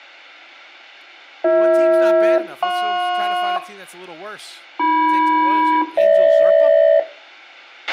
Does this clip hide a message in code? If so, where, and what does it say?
Yes: aircraft SELCAL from 1.4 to 7.0 s, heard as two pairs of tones, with a squelch burst at the end and speech in English. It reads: BH-JP AM-GH